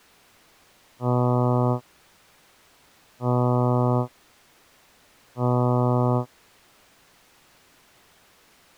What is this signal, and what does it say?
Ship horn signal, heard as a ship's horn, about 120 Hz. 3 short. At sea: I am operating astern propulsion.